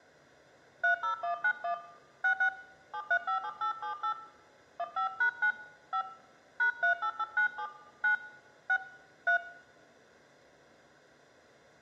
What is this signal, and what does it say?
DTMF, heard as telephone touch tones, dialled by hand, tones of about 80 ms, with room echo. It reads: 30191 66 7357878 15#9 5 #38897 9 6 3